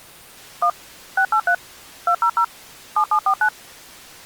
DTMF, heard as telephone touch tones, dialled by machine, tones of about 80 ms. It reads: 1 683 200 7749